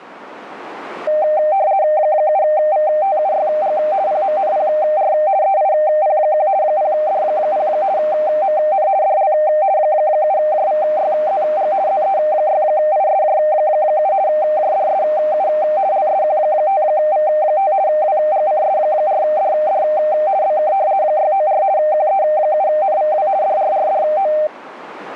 RTTY (50 baud, 170 Hz shift), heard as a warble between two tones, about 700 Hz centre, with radio static. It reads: 7VTUYG PMNPR EIP1 0D0 MN DL 7JVYZG ZE6ISJ7 JDSU LSQ5V5 WGCS4DD BK 694 QE7NVW DRRDO